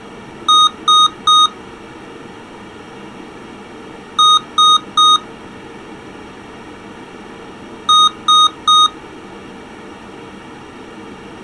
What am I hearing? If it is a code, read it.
Beep code, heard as beeps from a small speaker, played three times, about 1240 Hz. 3 short. In AMI BIOS tables: failure in the first 64 KB of memory; in Dell tables: chipset error.